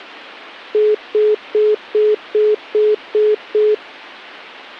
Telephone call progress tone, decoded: congestion tone

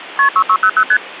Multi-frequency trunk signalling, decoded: KP 6600 ST

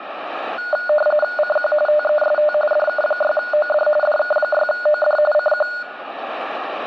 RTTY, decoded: CQ TEST DK6OD DK6OD CQ

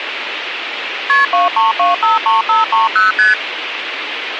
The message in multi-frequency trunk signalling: KP 23253530 ST

